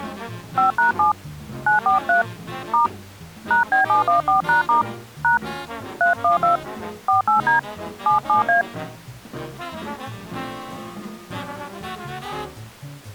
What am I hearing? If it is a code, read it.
DTMF, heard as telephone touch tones, dialled by hand, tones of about 130 ms. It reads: 5#7 943 * #B714#* # 312 48D 77A